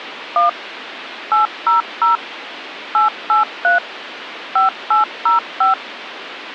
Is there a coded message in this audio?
Yes: DTMF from 0.4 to 5.7 s, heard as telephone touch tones, dialled by machine, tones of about 140 ms, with phone line noise. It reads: 1 800 883 5805